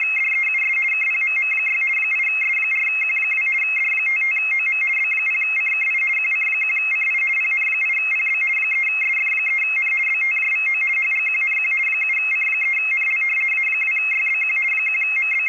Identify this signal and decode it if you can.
RTTY (50 baud, 450 Hz shift), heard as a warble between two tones, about 2350 Hz centre, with radio static. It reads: … KPMM6 8S4Q2 D55OM B0CKI QC1CI PN8PB 3SF3N BTJVO HGQNQ 7C3NL A2YBQ …